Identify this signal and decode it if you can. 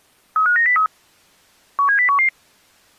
Five-tone selective call (CCIR), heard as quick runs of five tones, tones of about 100 ms. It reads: 35903 17011